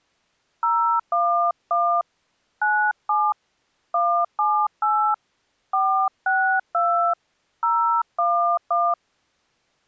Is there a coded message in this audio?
Yes: DTMF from 0.6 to 8.9 s, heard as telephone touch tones, dialled by hand, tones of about 290 ms. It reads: 011 97 178 462 011